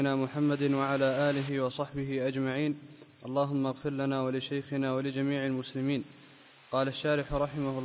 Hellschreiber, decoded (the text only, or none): none